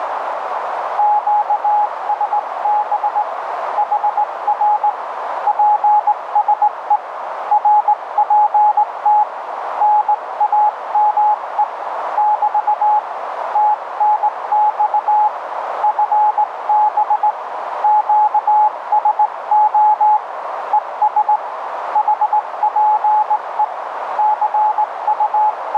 Morse code, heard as a keyed tone, hand-sent with a straight key, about 18 wpm, 840 Hz, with radio static and a narrow filter. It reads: QSB HR PSE RPT NAME <BT> TNX FB QSO ES HPE …